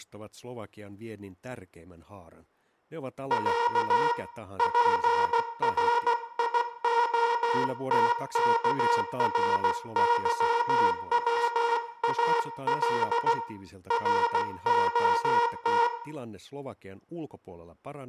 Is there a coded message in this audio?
Yes: Morse code (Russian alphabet) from 3.2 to 15.9 s, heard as a buzzer, hand-sent with a paddle, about 16 wpm, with room echo and speech in Finnish. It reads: Я ПРИОТКРЫВАЛ РОТ